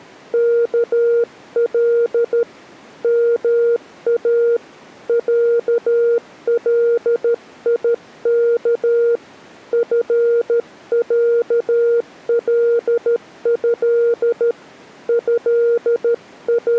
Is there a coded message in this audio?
Yes: Morse code (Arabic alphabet) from 0.3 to 16.8 s, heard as a keyed tone, hand-sent with a paddle, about 13 wpm, 470 Hz. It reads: كل ما عليك فعله …